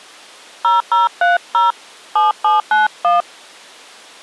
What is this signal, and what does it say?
DTMF, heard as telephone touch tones, dialled by hand, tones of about 160 ms. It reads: 0030 7791